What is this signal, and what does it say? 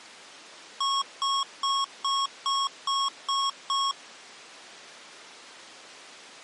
Beep code, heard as beeps from a small speaker, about 1100 Hz. 8 short. In AMI BIOS tables: display memory failure; in Dell tables: LCD failure.